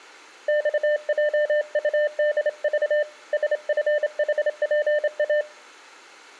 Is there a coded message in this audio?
Yes: Morse code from 0.4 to 5.5 s, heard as a keyed tone, hand-sent with a straight key, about 28 wpm, 600 Hz, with room echo. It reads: XJUDV SFHPA